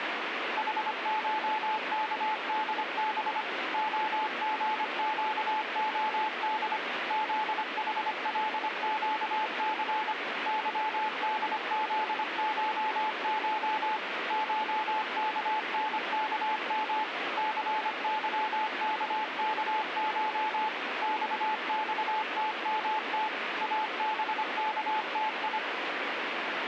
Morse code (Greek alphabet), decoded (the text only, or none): ΗΧΚΔΒ ΟΓΨΟΔ ΖΗΛΨΘ ΥΔΖΧΧ ΧΚΝΚΜ ΘΥΚΚΧ ΞΞΤΜΤ ΑΒΚΤΙ